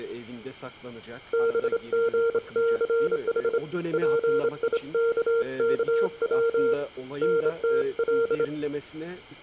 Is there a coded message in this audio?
Yes: Morse code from 1.3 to 8.5 s, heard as a keyed tone, hand-sent with a straight key, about 27 wpm, 460 Hz, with room echo and speech in Turkish. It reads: BGCH PIKKW NTL